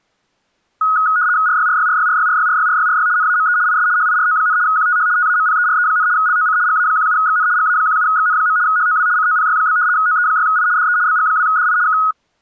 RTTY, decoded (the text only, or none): RYRYRYRYRYRYRYRY NAME IS HIRO, QTH TAMPERE, LOC GA17XN GA17XN. HOW COPY? OE6I DE BG2DI K